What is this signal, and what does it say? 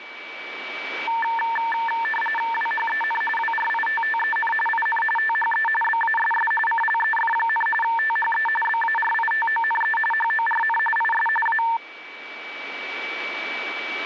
RTTY (45.45 baud, 850 Hz shift), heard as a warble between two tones, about 1340 Hz centre, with radio static and a steady whistle near 2300 Hz. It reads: WHEN WRITTEN IN THE BASS CLEF, THE BARITONE HORN IS A